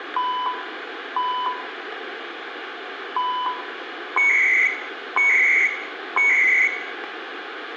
Radio time signal (CHU, Canada), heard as beeps and data bursts, one a second, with radio static and room echo.